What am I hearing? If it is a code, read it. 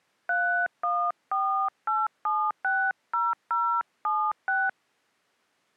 DTMF, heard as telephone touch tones, dialled by hand, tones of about 260 ms. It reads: 3148760076